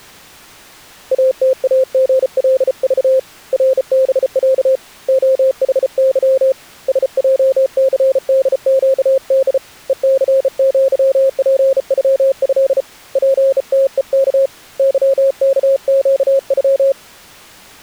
Morse code (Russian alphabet), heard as a keyed tone, hand-sent with a bug key, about 34 wpm, 530 Hz. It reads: АТАГЛЖ РБЯ ОХЫ СЙЦДЩД ЕЦЪПЮЭ ПТЕК ЫКЩЮ